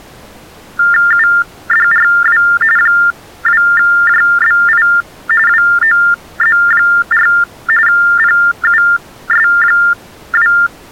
TTY/TDD text telephone tones (45.45 baud Baudot), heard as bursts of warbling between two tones, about 400 Hz shift, 1600 Hz centre. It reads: UDRW 2JBI WOZ4 PUS2